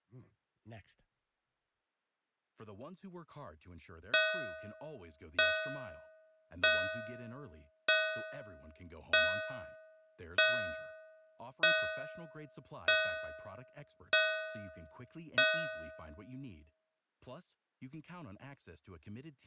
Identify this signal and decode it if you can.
Clock strike, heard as a bell, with speech in English. 10. Ten o'clock.